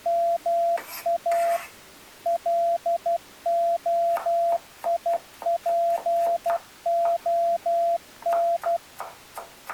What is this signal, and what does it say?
Morse code (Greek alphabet), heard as a keyed tone, machine-sent, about 12 wpm, 680 Hz, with kitchen noise. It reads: ΜΑ ΛΟΙΠΟΝ